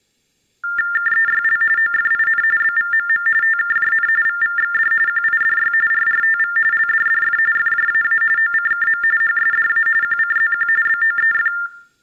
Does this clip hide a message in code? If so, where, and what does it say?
Yes: TTY/TDD text telephone tones (45.45 baud Baudot) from 0.6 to 11.7 s, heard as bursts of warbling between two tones, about 400 Hz shift, 1600 Hz centre. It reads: KEYL OFIN BVMM TKJN VVXD QIDY RRTV LDDF FJAA OCKM HSDA QCZQ BOEF